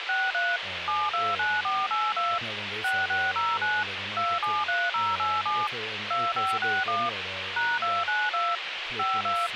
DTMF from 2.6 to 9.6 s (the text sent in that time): 6609 273087 2561 #292 52